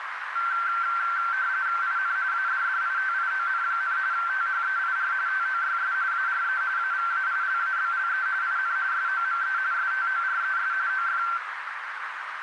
RTTY (45.45 baud, 170 Hz shift), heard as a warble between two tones, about 1460 Hz centre, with radio static and a narrow filter. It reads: IN ADDITION, THEIR TOYS ARE AVAILABLE IN SOME STORES OF